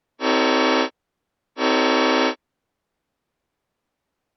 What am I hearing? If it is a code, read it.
Train horn signal, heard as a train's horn. 2 short. On North American railways: a signal is acknowledged.